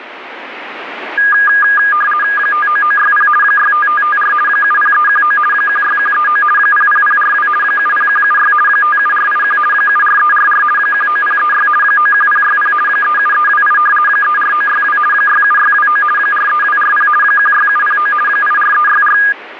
RTTY (50 baud, 450 Hz shift), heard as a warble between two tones, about 1430 Hz centre, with radio static. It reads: 59960 65554 70319 16139 00042 70176 57481 74344 19036 91060 37328 34962 67629 43240 16709 84364